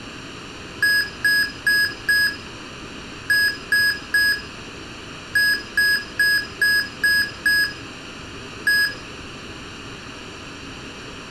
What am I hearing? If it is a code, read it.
Beep code, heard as beeps from a small speaker, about 1650 Hz, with room echo. 4-3-6-1.